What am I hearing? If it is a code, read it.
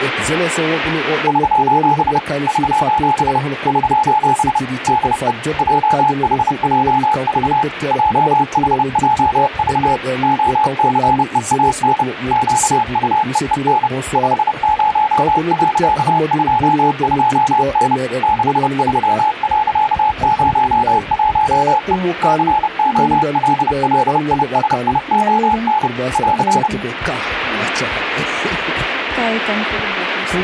Morse code, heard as a keyed tone, machine-sent, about 30 wpm, 860 Hz, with radio static. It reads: <SOS> <SOS> <SOS> DE JHJV JHJV OCEAN QUEEN 50.22N 63.01E COLLISION <AR>